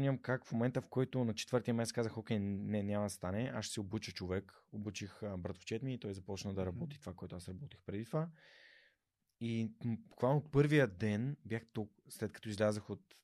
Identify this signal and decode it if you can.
Speech in Bulgarian. There is no code.